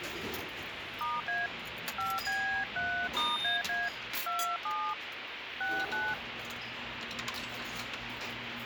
DTMF, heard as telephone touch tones, dialled by hand, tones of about 270 ms, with phone line noise and the noise of a restaurant. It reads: *A 5B3*AA 27 69